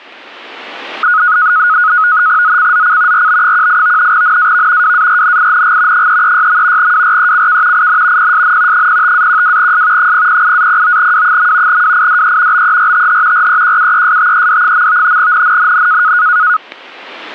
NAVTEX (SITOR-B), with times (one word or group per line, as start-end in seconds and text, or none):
2.4-3.3 ZCZC
3.1-4.1 RB18
4.1-4.9 NAV
4.8-6.1 WARNING
5.9-6.9 336.
6.8-7.9 WRECK
7.7-8.3 IN
8.2-8.9 PSN
8.7-10.1 05-12S
10.0-11.8 008-09W.
11.7-12.6 WIDE
12.5-13.5 BERTH
13.3-15.2 REQUESTED.
15.2-16.1 NNNN